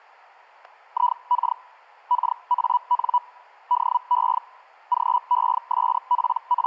Hellschreiber (Feld-Hell, 122.5 baud), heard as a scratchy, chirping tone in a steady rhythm, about 980 Hz. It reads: IK KAN DE …